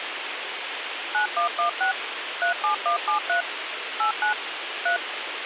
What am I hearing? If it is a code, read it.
DTMF, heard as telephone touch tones, dialled by machine, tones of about 110 ms, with radio hiss. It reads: 9116 37173 89 3